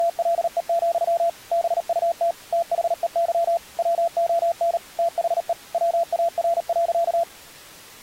Morse code, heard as a keyed tone, machine-sent, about 38 wpm, 680 Hz. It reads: … BUT THEY WON THE WAR.